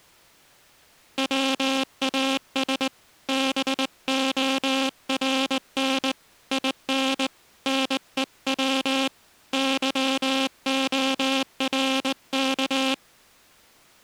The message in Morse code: WAS BORN IN NEW YORK

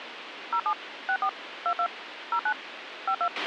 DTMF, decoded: 07 64 22 09 52

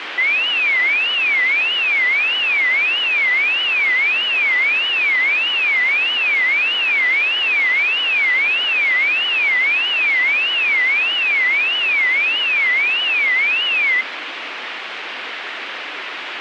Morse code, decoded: none

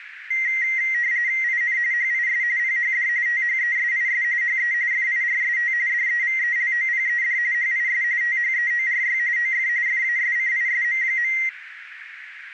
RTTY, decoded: IN HIS PHD THESIS HE FIRST DEVELOPED HIS THEORY OF FASCISM.

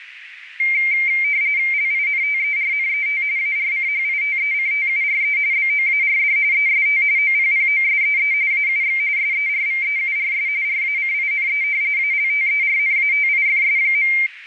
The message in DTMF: none

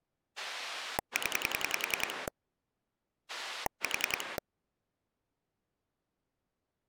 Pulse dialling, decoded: 0 4

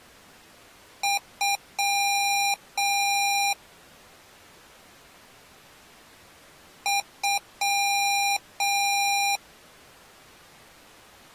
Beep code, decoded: 2 short, 2 long

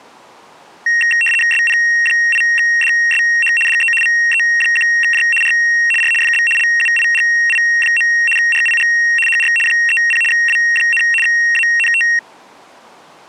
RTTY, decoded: SP8DSH DE VE1J R R FB LUIGI. RIG HR 30 W, ANT

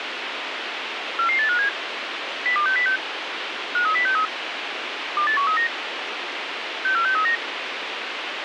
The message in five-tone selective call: 44857 02606 53063 28139 64639

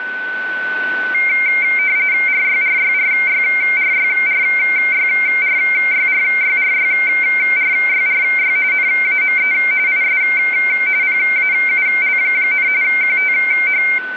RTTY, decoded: RYRYRYRYRYRYRYRYRYRY NAME IS PAUL, QTH

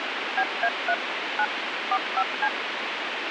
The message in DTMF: BA3 9 45C

